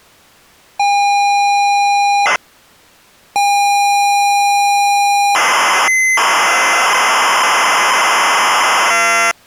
ZX Spectrum tape loading, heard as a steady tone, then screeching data.